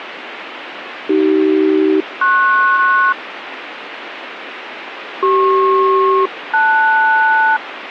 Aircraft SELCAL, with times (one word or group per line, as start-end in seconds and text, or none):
1.1-3.1 AC-PS
5.2-7.6 CP-LS